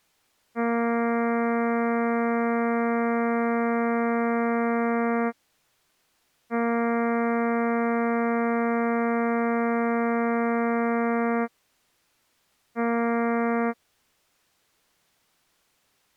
Ship horn signal, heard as a ship's horn, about 230 Hz. 2 long, 1 short. At sea: I intend to overtake on your starboard side.